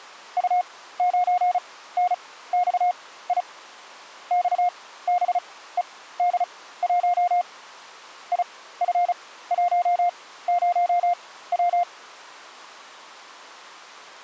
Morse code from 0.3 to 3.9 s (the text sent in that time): U9NXI